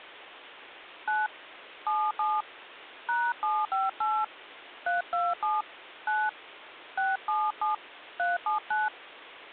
DTMF, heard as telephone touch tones, dialled by hand, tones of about 190 ms. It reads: 9 77 #758 327 9 677 379